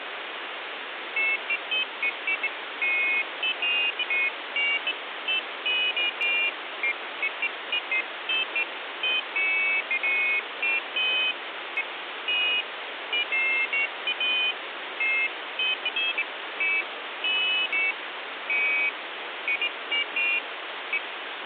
Pairs of high tones at irregular times, with phone line noise. There is no code.